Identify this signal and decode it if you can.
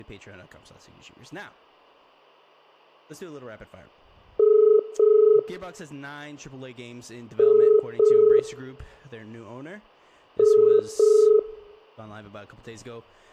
Telephone call progress tone (as in the UK, Ireland, Australia and similar networks), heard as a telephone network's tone, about 430 Hz, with hum, room echo and speech in English. Ringback tone.